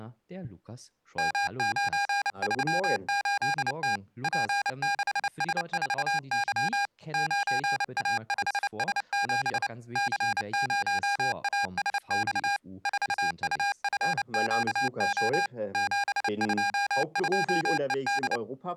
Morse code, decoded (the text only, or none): M938T P6S4Y 9A5S7 C0ASX 4UFQO 722ED